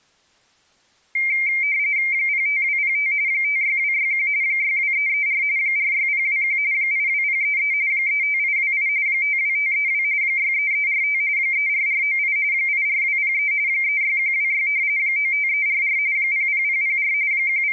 RTTY (45.45 baud, 170 Hz shift), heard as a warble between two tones, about 2200 Hz centre. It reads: 05205 56261 62334 46021 82033 35828 52532 63345 34498 84203 36126 95344 00004 …